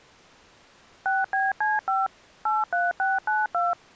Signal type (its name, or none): DTMF